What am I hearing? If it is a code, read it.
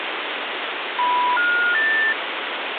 Telephone call progress tone (North American plan), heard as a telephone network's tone, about 980, 1430, 1800 Hz, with phone line noise. Special information tone.